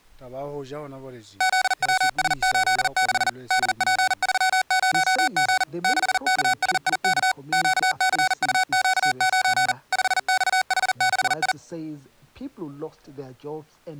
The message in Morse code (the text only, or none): ZWS86 DP30G 6KSIK QCUQ9 5XH6I